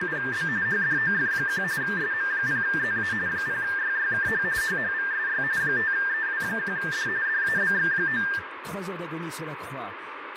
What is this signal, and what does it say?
RTTY (45.45 baud, 170 Hz shift), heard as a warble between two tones, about 1700 Hz centre, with radio static and room echo. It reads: … HDOF1 SM0ZA 0YYKH HHVSY 5EW1D DABX9